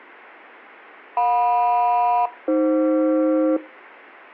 Aircraft SELCAL, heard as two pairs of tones. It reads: JM-AF